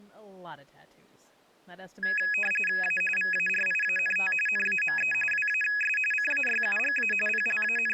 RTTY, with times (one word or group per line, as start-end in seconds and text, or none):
2.8-3.0 A
3.2-4.3 VARIANT
4.5-5.1 NAME
5.3-6.0 WAS
6.1-7.1 CAYUGA
7.3-7.9 …